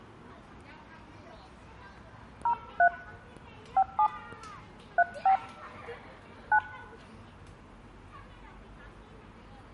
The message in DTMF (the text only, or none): 03 57 35 9